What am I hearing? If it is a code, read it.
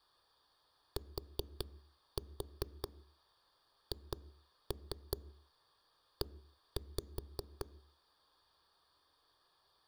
Tap code, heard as knocks on a wall, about 5 knocks a second, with room echo. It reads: THE